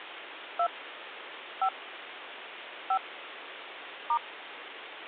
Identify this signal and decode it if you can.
DTMF, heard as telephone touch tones, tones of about 70 ms, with phone line noise. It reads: 2 5 5 *